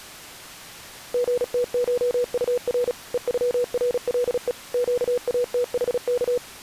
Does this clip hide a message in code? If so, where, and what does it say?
Yes: Morse code (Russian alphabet) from 1.1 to 6.4 s, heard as a keyed tone, machine-sent, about 36 wpm, 490 Hz. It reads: ГТШУР ЕЮРЛЕ ЩАТХК